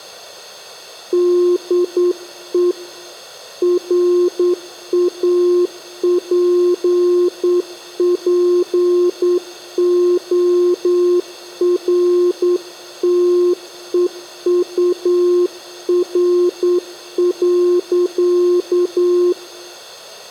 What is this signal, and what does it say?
Morse code, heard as a keyed tone, hand-sent with a straight key, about 9 wpm, 360 Hz, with room echo. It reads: DE RAPPORTEUR.